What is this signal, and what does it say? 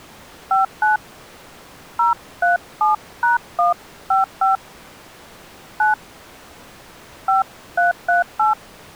DTMF, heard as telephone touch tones, dialled by hand, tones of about 140 ms. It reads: 59 037#155 9 5338